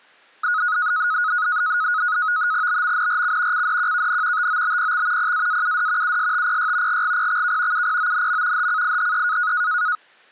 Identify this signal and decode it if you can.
NAVTEX (SITOR-B), 100 baud, 170 Hz shift, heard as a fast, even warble, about 1360 Hz centre. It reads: BMNRC CDQKN TOBPX PAAUD USTPY GGPXK UPONM HCIHE